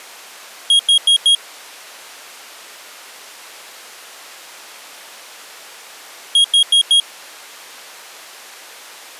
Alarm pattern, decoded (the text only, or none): temporal four